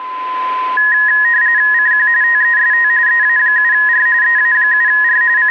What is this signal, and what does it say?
RTTY (45.45 baud, 170 Hz shift), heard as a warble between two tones, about 1800 Hz centre, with a steady whistle near 1020 Hz. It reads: CQ TEST EA7R EA7R …